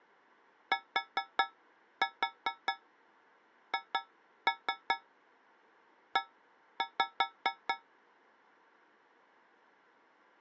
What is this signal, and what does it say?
Tap code, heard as taps on a metal pipe, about 4 knocks a second. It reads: THE